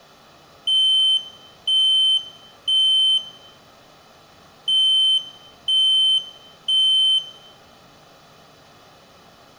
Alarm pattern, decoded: temporal three

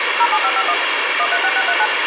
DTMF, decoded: 07551 136639

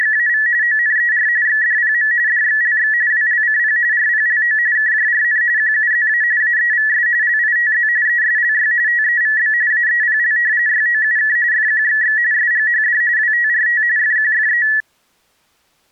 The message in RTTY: … ONER XDPM DXLX WLCP RPLO KJRN QUZA AEVS LITZ ESLY TEVB AEPL YOUK FQXX SGHD WTRT FQFE

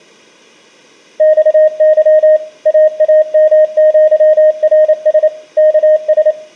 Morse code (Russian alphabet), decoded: ЬЫ ААМЪРС КС

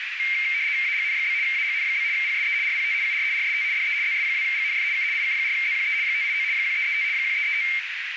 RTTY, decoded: AGN? AGN? PSE RPT UR RST DE ZS2GNF K IK4ZQE 589 1335 1335

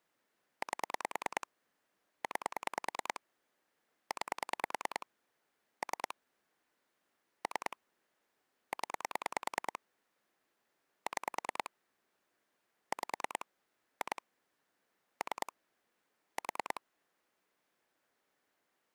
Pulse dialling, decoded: 8 9 9 3 3 0 6 5 2 3 4

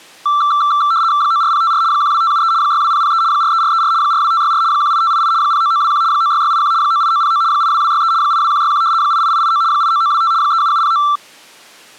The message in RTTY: 94054 12573 62003 43434 42564 18588 09921 96681 98909 82263 82161 88889 89925 37709

